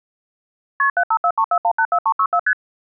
Multi-frequency trunk signalling (R1, as on North American trunks), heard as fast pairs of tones, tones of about 70 ms. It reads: KP 75434184364 ST